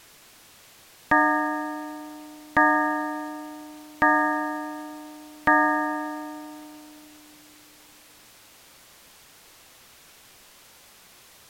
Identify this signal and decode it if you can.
Clock strike, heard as a bell. 4. Four o'clock.